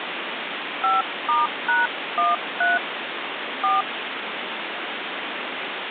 DTMF, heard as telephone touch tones, dialled by hand, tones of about 170 ms, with phone line noise. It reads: 5*#13 4